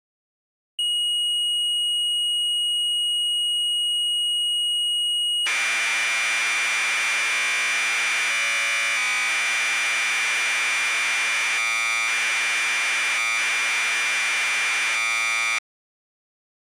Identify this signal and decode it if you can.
Commodore tape loading (standard loader), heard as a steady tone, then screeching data.